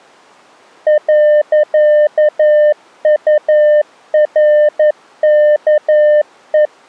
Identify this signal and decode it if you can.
Morse code, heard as a keyed tone, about 11 wpm, 600 Hz. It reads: .URKE